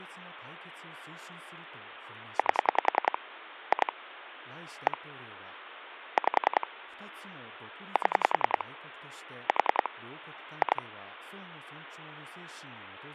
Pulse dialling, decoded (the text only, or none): 8 2 1 5 7 4 2